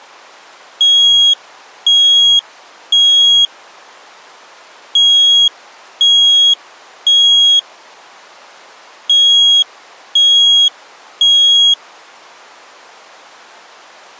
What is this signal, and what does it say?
Alarm pattern, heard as an alarm's beeps, played three times, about 3300 Hz. Temporal three. Smoke or fire, evacuate.